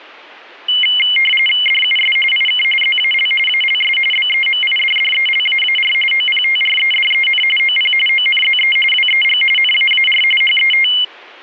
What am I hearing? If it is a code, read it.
RTTY (45.45 baud, 850 Hz shift), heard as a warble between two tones, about 2550 Hz centre. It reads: DUS IK ZAL ALS BEMIDDELAAR OPTREDEN OP ONZE WEG NAAR HET